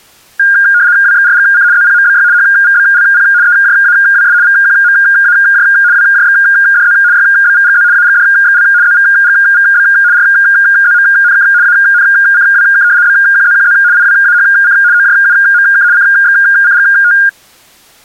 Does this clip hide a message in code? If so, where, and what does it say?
Yes: RTTY (75 baud, 170 Hz shift) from 0.4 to 17.3 s, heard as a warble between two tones, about 1500 Hz centre. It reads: WXRGC ZPMBY HVBLP EJAWS VQMAJ WJXDZ YBVGZ AGDXL ZVGVB RZMNK ANCWK BQZQZ IWAHC OJUMK CXCGT